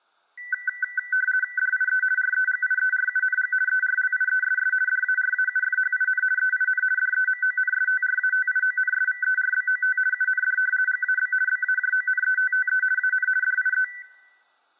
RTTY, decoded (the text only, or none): DIE REGIERUNG ERLIESS DARAUFHIN EIN DEMONSTRATIONSVERBOT UND GAB BAJONETTE AN DIE